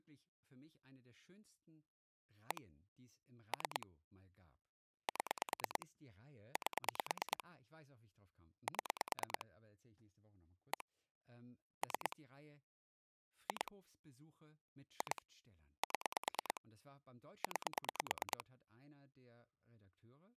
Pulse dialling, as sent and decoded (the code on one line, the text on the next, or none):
1 / 3 / 7 / 8 / 7 / 1 / 3 / 2 / 2 / 7 / 9
1 3 7 8 7 1 3 2 2 7 9